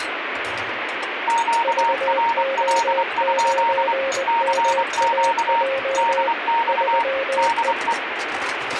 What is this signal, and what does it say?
Morse code, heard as two keyed tones, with radio static and kitchen noise. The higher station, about 24 wpm, 930 Hz: QRL? CQ DX DE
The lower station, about 20 wpm, 540 Hz: VO9MAJ 3E